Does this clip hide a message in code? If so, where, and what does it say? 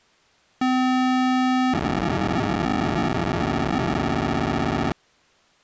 Yes: POCSAG pager data (512 baud) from 0.6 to 4.9 s, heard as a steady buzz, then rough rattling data.